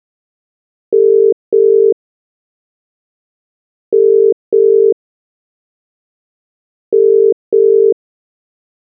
Telephone call progress tone (as in the UK, Ireland, Australia and similar networks), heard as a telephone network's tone, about 400, 450 Hz. Ringback tone.